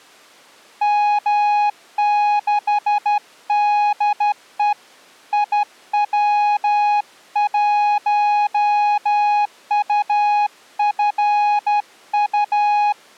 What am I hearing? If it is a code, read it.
Morse code, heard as a keyed tone, hand-sent with a straight key, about 12 wpm, 830 Hz. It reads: M6DE IW1UFU